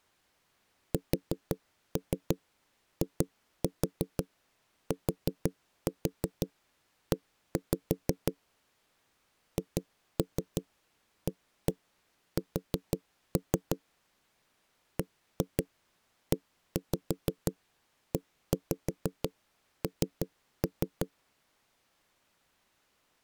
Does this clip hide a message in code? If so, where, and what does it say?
Yes: tap code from 0.9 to 21.1 s, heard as knocks on wood, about 6 knocks a second. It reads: SITE HAS BEEN